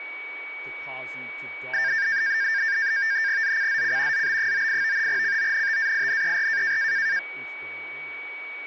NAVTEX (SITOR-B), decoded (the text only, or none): ZCZC ZB98 CONTAINER